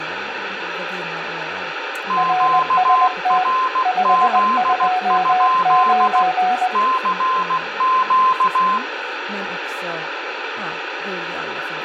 Morse code, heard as two keyed tones, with radio static, room echo and speech in Swedish. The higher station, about 16 wpm, 1040 Hz: QRZ? CQ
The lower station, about 20 wpm, 740 Hz: RST 529